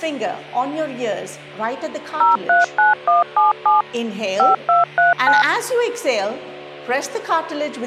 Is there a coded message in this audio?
Yes: DTMF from 2.2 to 5.4 s, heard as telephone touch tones, dialled by machine, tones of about 150 ms. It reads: 039177 5239